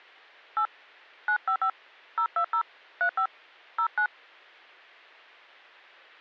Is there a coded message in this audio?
Yes: DTMF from 0.6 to 4.1 s, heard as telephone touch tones, dialled by hand, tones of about 80 ms. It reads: 8 955 020 35 09